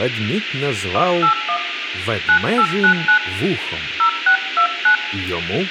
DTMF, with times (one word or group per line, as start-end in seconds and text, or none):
0.9-1.6 181
2.3-3.2 9899
4.0-5.0 0629